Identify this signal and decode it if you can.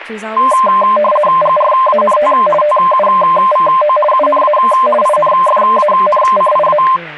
RTTY (50 baud, 450 Hz shift), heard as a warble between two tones, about 820 Hz centre, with speech in English. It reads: GRANT TUVO UNA INFANCIA